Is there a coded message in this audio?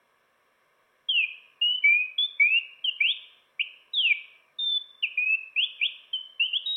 No, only bird-like chirps, with room echo.